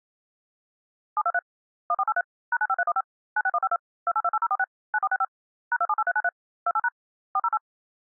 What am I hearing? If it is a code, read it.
DTMF, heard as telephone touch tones, dialled by machine, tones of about 50 ms. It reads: 723 1483 #95315 96152 2828046 9465 #278393 28# 408